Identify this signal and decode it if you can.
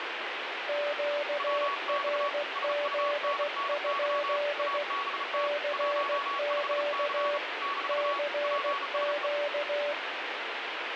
Morse code, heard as two keyed tones, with radio static. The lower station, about 16 wpm, 580 Hz: QRZ? CQ CQ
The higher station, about 35 wpm, 1120 Hz: WX SUNNY ABT 15C - PSE